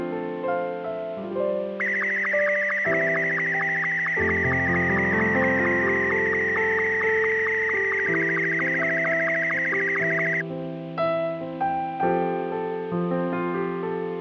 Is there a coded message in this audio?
Yes: SSTV (slow-scan television), Martin M2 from 1.8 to 10.4 s, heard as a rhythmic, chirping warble.